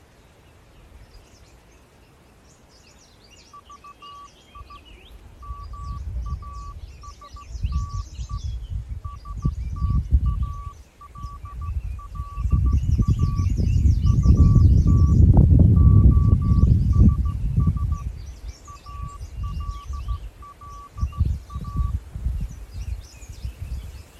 Morse code, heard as a keyed tone, hand-sent with a straight key, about 15 wpm, 1150 Hz. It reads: VI MASTE STALLA UT OSS ALLA